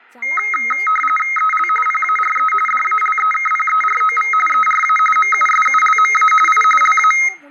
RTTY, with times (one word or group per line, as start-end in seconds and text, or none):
1.4-1.7 EL
1.9-2.5 PARE
2.7-4.3 DALEKPEROV
4.5-5.0 ERA
5.2-6.3 MUSULMA
6.5-6.6 I
6.8-7.1 LA